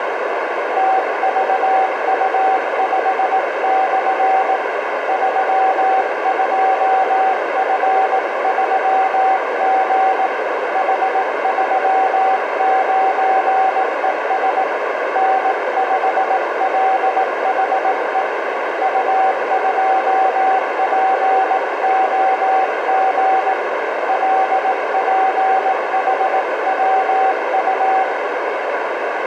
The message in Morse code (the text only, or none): TVU5/ 32F3G H39ES N5LHE U2POG LPHWU